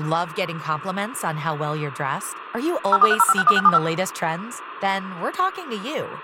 DTMF, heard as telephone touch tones, dialled by machine, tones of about 40 ms, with speech in English. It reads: 0430561675